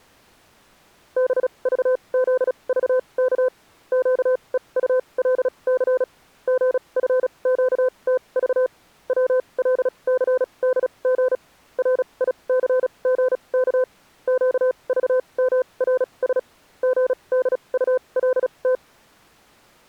Morse code, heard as a keyed tone, machine-sent, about 36 wpm, spaced as for 27 wpm, 510 Hz. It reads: BVZVK QEULC GFQTV WLCDG RICGK QVMRS GDULT